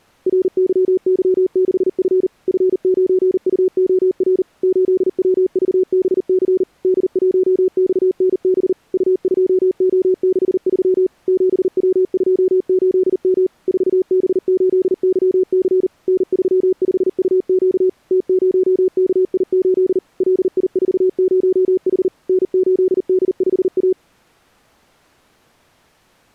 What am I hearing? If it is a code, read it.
Morse code, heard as a keyed tone, machine-sent, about 39 wpm, 370 Hz. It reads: RYY6F F9UOR 8WVBC D1XNB U2O63 7W28M 4B8YC N35UQ T0KI8 LI40H N8D5A